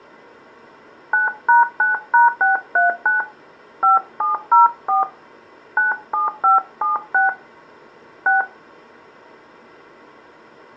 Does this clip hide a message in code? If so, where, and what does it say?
Yes: DTMF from 1.1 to 8.4 s, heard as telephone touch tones, dialled by hand, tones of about 150 ms. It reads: 9#9#639 5704 97576 6